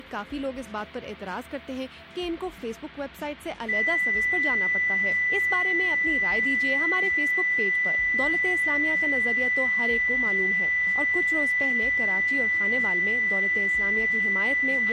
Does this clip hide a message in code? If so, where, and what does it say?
No, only a steady tone, with a squelch burst at the end and room echo.